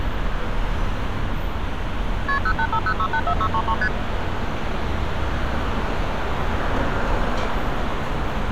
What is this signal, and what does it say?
Multi-frequency trunk signalling (R1, as on North American trunks), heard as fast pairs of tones, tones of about 70 ms, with street noise. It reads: KP 0850684633 ST